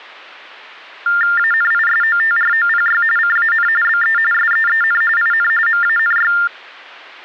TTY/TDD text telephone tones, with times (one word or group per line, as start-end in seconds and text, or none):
1.4-3.0 ANISOTROPY
3.2-3.7 CAN
3.8-4.2 BE
4.3-5.0 SEEN
5.2-5.5 IN
5.7-6.3 MANY